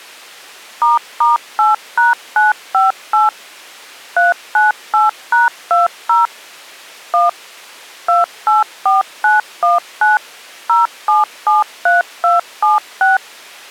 DTMF, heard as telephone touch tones, dialled by machine, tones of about 160 ms. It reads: **8#958 398#20 1 284919 0773276